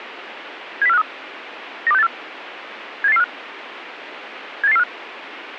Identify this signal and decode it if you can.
Five-tone selective call (EEA), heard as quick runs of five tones, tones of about 40 ms, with radio hiss. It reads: 70453 92684 78845 78845